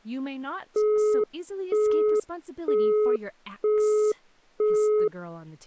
Telephone call progress tone (single-tone plan, as in Europe, Japan and elsewhere), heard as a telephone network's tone, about 420 Hz, 0.48 s on and 0.48 s off, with speech in English. Busy tone.